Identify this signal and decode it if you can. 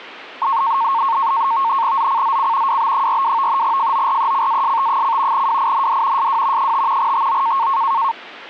NAVTEX (SITOR-B), 100 baud, 170 Hz shift, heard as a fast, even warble, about 1000 Hz centre. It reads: ZCZC WB42 FORECAST: WIND SW 5 TO